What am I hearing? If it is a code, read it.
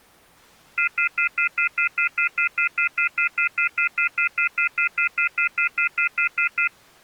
Telephone call progress tone (North American plan), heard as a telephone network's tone, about 1400, 2050, 2450, 2600 Hz, 0.1 s on and 0.1 s off. Off-hook warning tone.